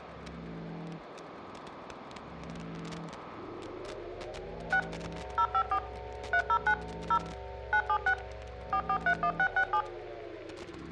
DTMF, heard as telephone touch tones, dialled by machine, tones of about 70 ms. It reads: 6 054 309 0 976 4431667